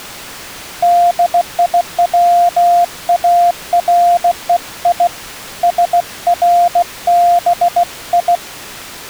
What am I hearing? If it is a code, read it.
Morse code (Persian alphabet), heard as a keyed tone, hand-sent with a bug key, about 16 wpm, 700 Hz. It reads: دیوارهی سربی